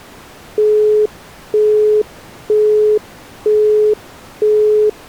Telephone call progress tone (single-tone plan, as in Europe, Japan and elsewhere), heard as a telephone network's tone, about 420 Hz, 0.48 s on and 0.48 s off. Busy tone.